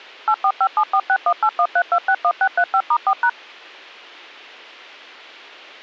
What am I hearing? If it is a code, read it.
DTMF, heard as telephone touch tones, dialled by machine, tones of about 70 ms. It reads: 8457461813261635*4#